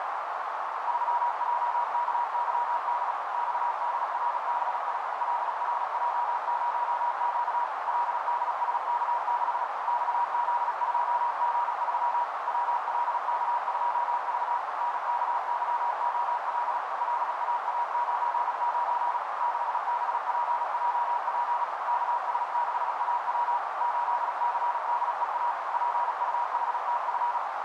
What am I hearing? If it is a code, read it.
Morse code, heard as a keyed tone, machine-sent, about 36 wpm, 960 Hz, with heavy radio static and a narrow filter. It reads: 3JKYD XDRBI LRJ0Q LDSK6 XZ2G3 WLK2V NKYOL LAA99 6BPJP KS6AW 8CDEA PUHTF